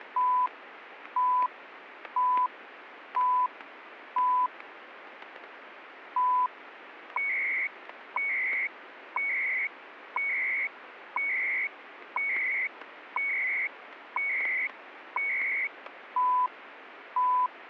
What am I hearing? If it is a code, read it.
Radio time signal (CHU, Canada), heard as beeps and data bursts, one a second, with radio static and static crashes.